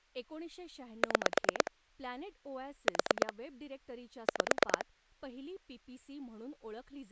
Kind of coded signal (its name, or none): pulse dialling